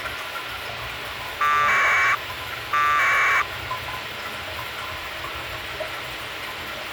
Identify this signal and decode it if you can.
Packet radio (AX.25, as in APRS), 1200 baud, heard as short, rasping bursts, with radio hiss, a squelch burst at the end and the noise of a restroom.